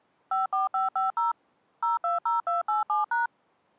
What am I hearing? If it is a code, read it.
DTMF, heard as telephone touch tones, dialled by machine, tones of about 150 ms. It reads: 54550 020287#